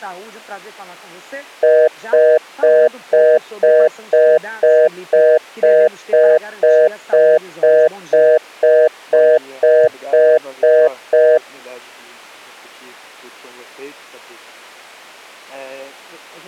Telephone call progress tone (North American plan), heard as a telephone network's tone, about 480, 620 Hz, 0.25 s on and 0.25 s off. Congestion tone.